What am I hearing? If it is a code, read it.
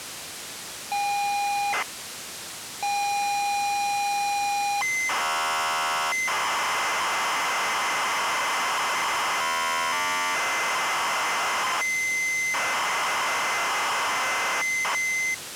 ZX Spectrum tape loading, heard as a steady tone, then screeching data, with tape hiss.